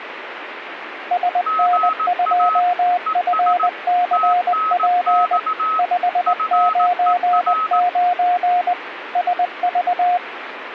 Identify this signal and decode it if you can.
Morse code, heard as two keyed tones, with radio static. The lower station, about 20 wpm, 710 Hz: SN2FCP 599 SV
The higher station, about 18 wpm, 1280 Hz: GA ES TNX FER